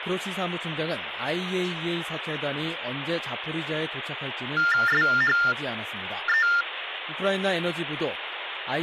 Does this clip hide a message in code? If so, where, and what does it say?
Yes: TTY/TDD text telephone tones (45.45 baud Baudot) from 4.6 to 6.6 s, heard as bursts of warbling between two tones, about 400 Hz shift, 1600 Hz centre, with phone line noise. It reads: SHE